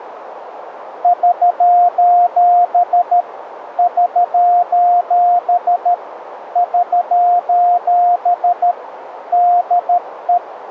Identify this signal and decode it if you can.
Morse code, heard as a keyed tone, hand-sent with a paddle, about 13 wpm, 710 Hz, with radio static and a narrow filter. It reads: <SOS> <SOS> <SOS> DE